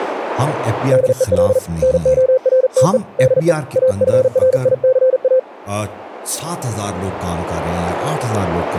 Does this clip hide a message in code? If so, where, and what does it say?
Yes: Morse code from 0.9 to 5.5 s, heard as a keyed tone, hand-sent with a paddle, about 40 wpm, 520 Hz, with speech in Urdu. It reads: DEL NORTE DE AFRICA